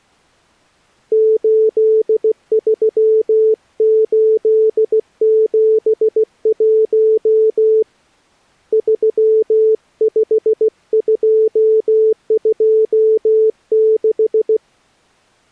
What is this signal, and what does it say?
Morse code, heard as a keyed tone, hand-sent with a paddle, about 16 wpm, 440 Hz. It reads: 83871 35226